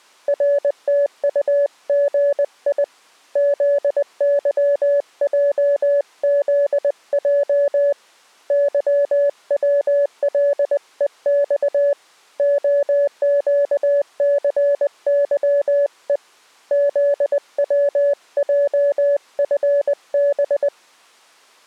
Morse code, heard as a keyed tone, hand-sent with a paddle, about 20 wpm, 570 Hz. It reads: RTUGI ZYJZJ YWLEX OQCYE ZWJFB